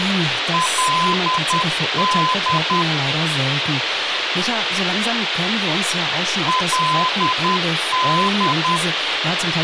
Morse code, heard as a keyed tone, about 10 wpm, 1020 Hz, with radio hiss and speech in German. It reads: LD LD